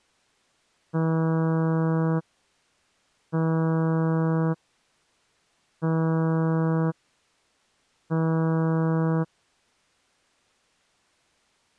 Ship horn signal, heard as a ship's horn, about 160 Hz. 4 short. At sea: a pilot vessel's identity signal in fog.